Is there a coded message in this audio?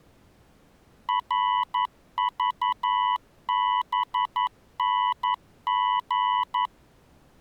Yes: Morse code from 1.0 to 6.7 s, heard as a keyed tone, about 11 wpm, 990 Hz. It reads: RVBNG